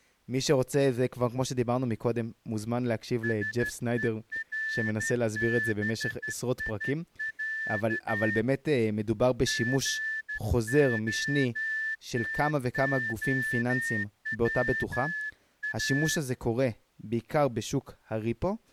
Morse code (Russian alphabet), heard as a whistle, hand-sent with a straight key, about 13 wpm, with speech in Hebrew. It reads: СЕРБИЯ ГОТОВА